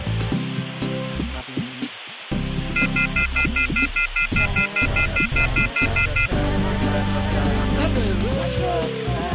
Telephone call progress tone (North American plan), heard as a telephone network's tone, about 1400, 2050, 2450, 2600 Hz, 0.1 s on and 0.1 s off, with phone line noise. Off-hook warning tone.